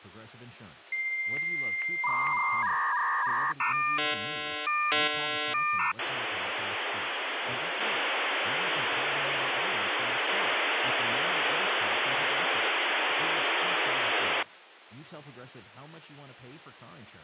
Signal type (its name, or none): dial-up modem handshake